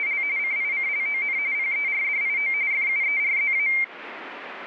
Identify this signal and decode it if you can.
RTTY (45.45 baud, 170 Hz shift), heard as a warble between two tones, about 2200 Hz centre. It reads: … CICLON PERDIO FUERZA